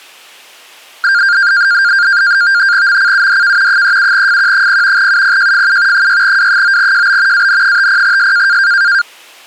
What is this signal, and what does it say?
NAVTEX (SITOR-B), 100 baud, 170 Hz shift, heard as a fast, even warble, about 1500 Hz centre. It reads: MCUDK 37FQ0 UPJFU 6W9JB AN50S